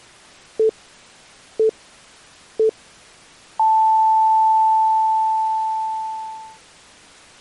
Radio time signal (three low pips and a long one an octave up, as on NHK), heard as pips.